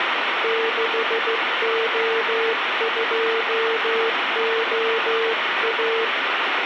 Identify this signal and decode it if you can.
Morse code, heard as a keyed tone, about 15 wpm, 450 Hz, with radio static. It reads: 6O2OA